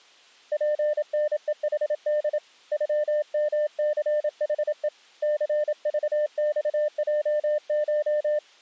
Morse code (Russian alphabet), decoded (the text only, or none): ПНЕХД ЮМЦХЕ ЦЖЬЙШ